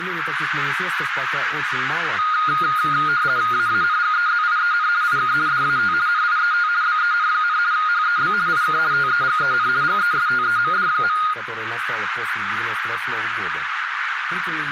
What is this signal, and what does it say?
RTTY (50 baud, 170 Hz shift), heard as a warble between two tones, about 1330 Hz centre, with radio static and a narrow filter. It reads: AANGEZIEN IK DAT NIET BEN, HEB IK TEGEN GESTEMD.